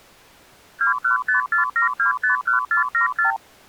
Multi-frequency trunk signalling (R2, with the far end's replies), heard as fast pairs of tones, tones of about 120 ms. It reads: 21547251474